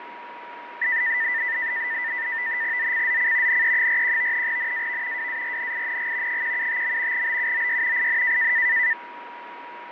NAVTEX (SITOR-B), 100 baud, 170 Hz shift, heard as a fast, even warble, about 1900 Hz centre, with radio static, fading and a steady whistle near 960 Hz. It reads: ZCZC NE41 NAV WARNING 175. BUOY IN